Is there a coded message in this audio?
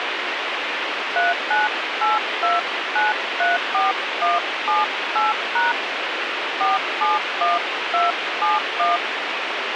Yes: DTMF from 1.2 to 9.0 s, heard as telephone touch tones, dialled by hand, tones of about 170 ms, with radio hiss. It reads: 3982934178# 471271